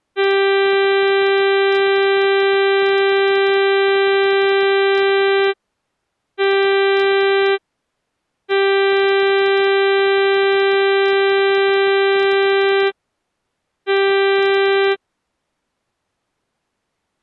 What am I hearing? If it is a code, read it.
Ship horn signal, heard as a ship's horn, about 390 Hz. 1 long, 1 short, 1 long, 1 short. At sea: I agree to be overtaken.